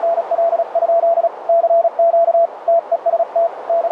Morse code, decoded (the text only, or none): … CQ TEST …